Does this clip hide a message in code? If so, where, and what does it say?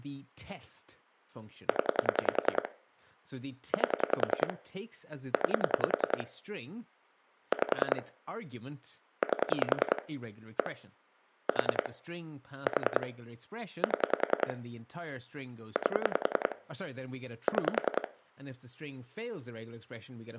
Yes: pulse dialling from 1.7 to 18.1 s, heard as clicks on a phone line, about 10 pulses a second, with speech in English. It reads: 0 8 9 5 8 1 4 4 7 8 6